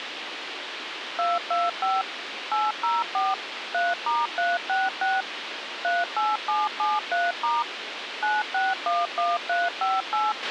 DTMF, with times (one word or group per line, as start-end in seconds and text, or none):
1.2-2.0 225
2.5-3.3 804
3.7-5.2 3*366
5.8-7.6 38773*
8.2-10.3 9611358